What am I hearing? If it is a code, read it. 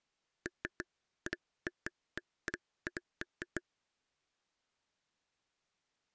Irregular taps on a table. There is no code.